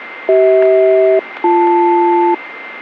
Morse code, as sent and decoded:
none

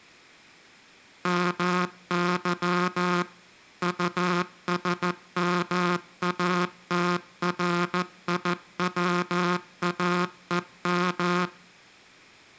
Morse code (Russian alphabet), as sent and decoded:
-- -.-- / ..- ... -- .- - .-. .. .-- .- . --
МЫ УСМАТРИВАЕМ

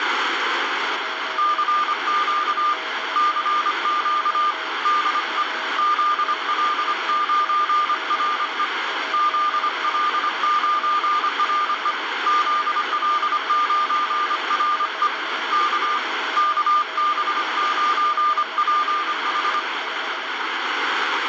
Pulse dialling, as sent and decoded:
none

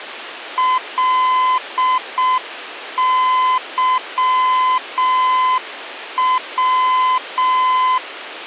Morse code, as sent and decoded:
.-.. -.-- .--
LYW

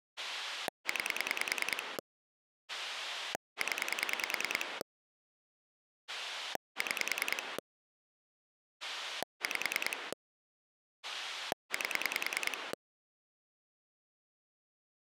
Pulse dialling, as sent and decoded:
9 / 10 / 6 / 5 / 8
9 0 6 5 8

